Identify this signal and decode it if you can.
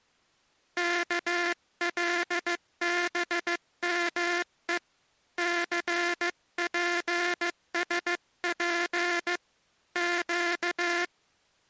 Morse code, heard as a buzzer, hand-sent with a paddle, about 15 wpm. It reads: KLBME CPSP Q